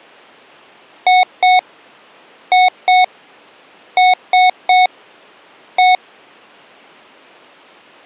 Beep code, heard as beeps from a small speaker, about 740 Hz. 2-2-3-1. In Phoenix BIOS tables: unexpected interrupt.